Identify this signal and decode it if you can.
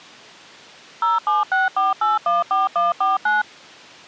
DTMF, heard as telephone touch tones, dialled by machine, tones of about 170 ms. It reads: 0764814149